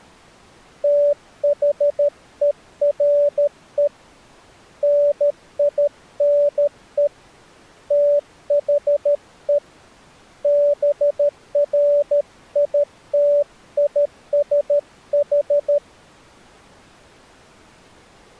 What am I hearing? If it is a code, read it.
Morse code, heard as a keyed tone, hand-sent with a paddle, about 13 wpm, 580 Hz. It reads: THERE NINE THE BRITISH